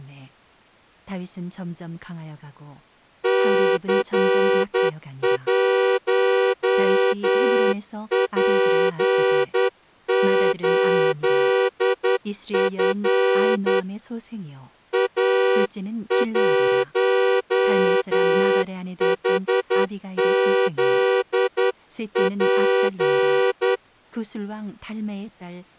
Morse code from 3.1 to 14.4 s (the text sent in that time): C1P8F